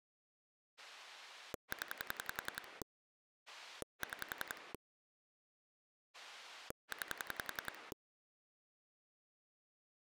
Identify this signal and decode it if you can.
Pulse dialling, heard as a rotary dial, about 10 pulses a second. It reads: 0 6 9